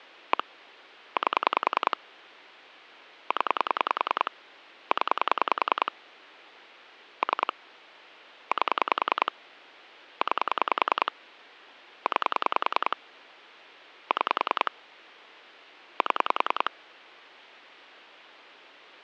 Pulse dialling, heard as clicks on a phone line, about 10 pulses a second. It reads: 1 8 0 0 3 8 9 9 6 7